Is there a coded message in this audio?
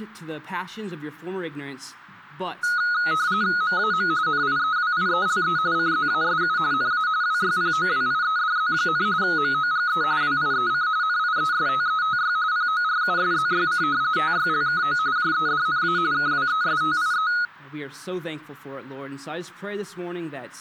Yes: RTTY (45.45 baud, 170 Hz shift) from 2.6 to 17.5 s, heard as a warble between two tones, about 1360 Hz centre. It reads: MAM NIEWIELE CZASU NA WYPOWIEDZ, MOGE WIEC NIESTETY PORUSZYC TYLKO JEDNA KWESTIE